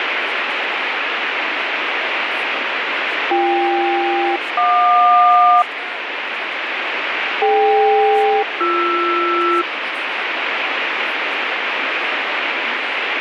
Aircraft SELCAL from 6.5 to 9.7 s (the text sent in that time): DK-BR